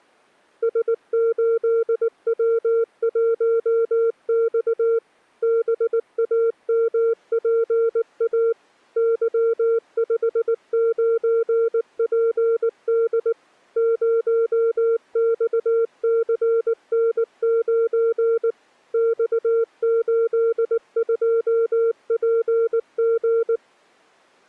Morse code, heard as a keyed tone, machine-sent, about 19 wpm, 460 Hz. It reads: S8W1X BAMPA Y59PD 0XCN9 X82PG